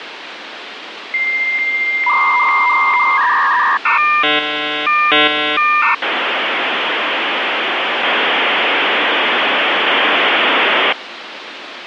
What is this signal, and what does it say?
Dial-up modem handshake (V.34 or later), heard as a whistle, warbles, then hiss, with phone line noise.